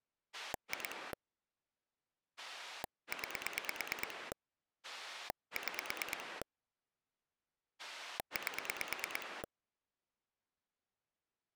Pulse dialling, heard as a rotary dial, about 9 pulses a second. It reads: 2 9 6 8